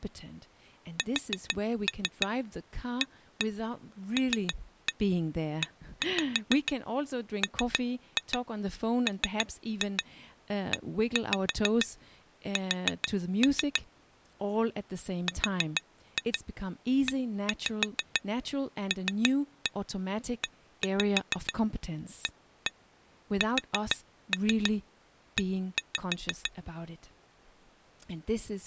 Tap code, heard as taps on glass, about 6 knocks a second, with speech in English. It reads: SALEMMES RELEASE